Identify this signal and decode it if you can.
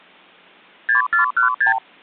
Multi-frequency trunk signalling (R2, with the far end's replies), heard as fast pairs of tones, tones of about 120 ms. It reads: 6416